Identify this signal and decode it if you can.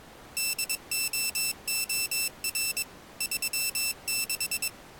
Morse code, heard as a high beeper, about 22 wpm, 2650 Hz. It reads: DOOR 36